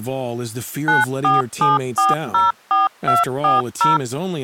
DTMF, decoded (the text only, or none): 947404240